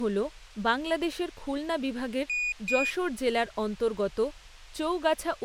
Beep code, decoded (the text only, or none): 2 short